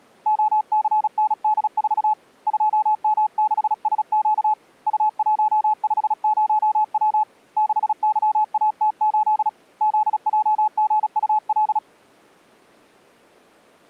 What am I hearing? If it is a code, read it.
Morse code, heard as a keyed tone, hand-sent with a paddle, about 36 wpm, 860 Hz. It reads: OCND4 2M6SQ U150W 6YAT8 ZJGUL